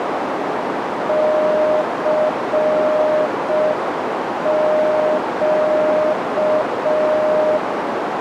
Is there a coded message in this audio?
Yes: Morse code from 1.0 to 7.6 s, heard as a keyed tone, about 5 wpm, 620 Hz, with heavy radio static and a narrow filter. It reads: CQ